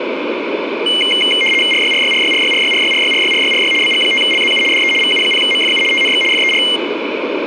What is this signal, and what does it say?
RTTY (75 baud, 850 Hz shift), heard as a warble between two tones, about 2550 Hz centre, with radio static. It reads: RYRYRYRYRYRYRYRYRYRY BG5LZU DE VU0MFU TNX FER